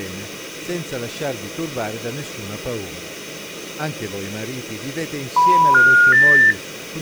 Telephone call progress tone (North American plan), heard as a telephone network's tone, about 980, 1430, 1800 Hz, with speech in Italian. Special information tone.